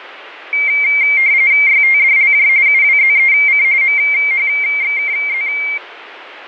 RTTY (45.45 baud, 170 Hz shift), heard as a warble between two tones, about 2200 Hz centre, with radio static. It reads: YTDLJ UWZEC MHXKZ